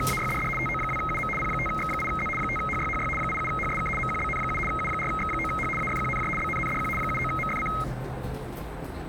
RTTY (75 baud, 850 Hz shift), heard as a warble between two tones, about 1700 Hz centre, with the noise inside a lift. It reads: … TO2UM P5X8Z 5HYHY 87HSK MQBN7 U4X9H AFQNJ BNNDQ 79MFC